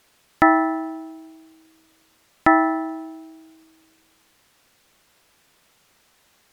Clock strike, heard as a bell. 2. Two o'clock.